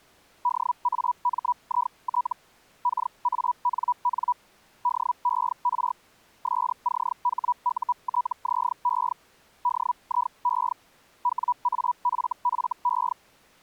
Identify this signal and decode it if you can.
Hellschreiber (Feld-Hell, 122.5 baud), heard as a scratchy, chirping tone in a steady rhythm, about 980 Hz. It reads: DAMIT KANN DER SCHUTZE DIE WAFFE